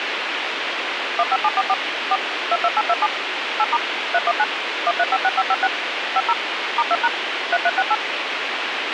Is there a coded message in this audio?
Yes: DTMF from 1.2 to 7.9 s, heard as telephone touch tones, dialled by machine, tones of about 50 ms, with radio hiss and a squelch burst at the end. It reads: 15744 4 22827 8* 319 1356556 50 *2# 3368